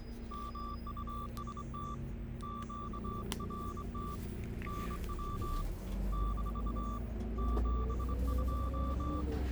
Morse code, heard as a keyed tone, hand-sent with a straight key, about 24 wpm, 1170 Hz, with radio static and the noise inside a bus. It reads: MUST QRT NW - 72